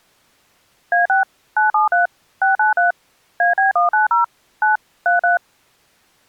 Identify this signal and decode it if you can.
DTMF, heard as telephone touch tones, dialled by machine, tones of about 140 ms. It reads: A6 973 693 AB190 9 33